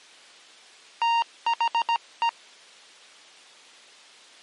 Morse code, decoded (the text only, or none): THE